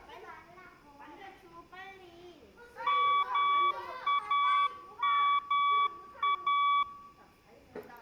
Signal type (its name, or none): Morse code